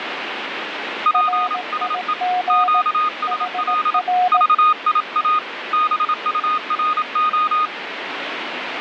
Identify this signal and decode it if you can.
Morse code, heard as two keyed tones, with radio static. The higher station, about 27 wpm, 1240 Hz: PSE QSL VIA BURO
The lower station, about 18 wpm, 730 Hz: RIG HR